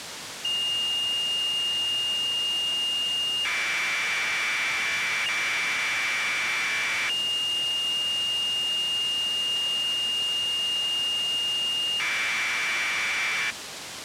Commodore tape loading (standard loader), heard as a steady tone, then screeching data, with tape hiss.